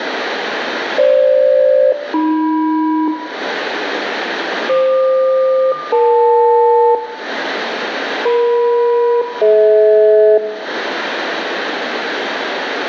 Aircraft SELCAL, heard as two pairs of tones, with radio static and room echo. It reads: FG-AM FQ-EL EM-DH